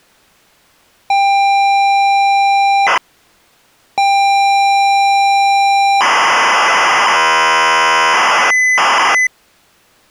ZX Spectrum tape loading, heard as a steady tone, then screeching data.